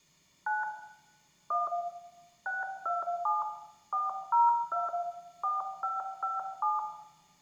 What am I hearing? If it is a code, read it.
DTMF, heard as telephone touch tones, dialled by machine, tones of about 170 ms, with room echo. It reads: 9 1 627 402 4557